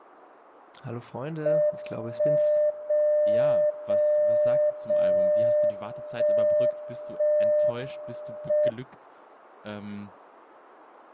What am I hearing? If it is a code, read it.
Radio time signal (WWVB), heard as a tone whose level steps once a second, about 600 Hz, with speech in German. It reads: 1 0 0 0 1 1 M